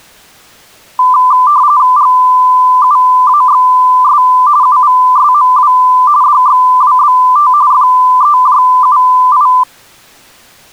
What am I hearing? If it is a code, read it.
RTTY (45.45 baud, 170 Hz shift), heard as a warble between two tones, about 1090 Hz centre. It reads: GUAXS UVSMW DXWBT FEJUI